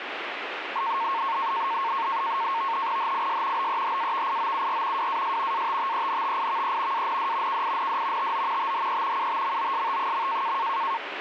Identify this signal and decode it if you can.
NAVTEX (SITOR-B), 100 baud, 170 Hz shift, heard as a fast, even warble, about 1000 Hz centre, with radio static. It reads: HIS BEHAVIOUR WAS ATTENTIVE AND KIND TO THE UTMOST.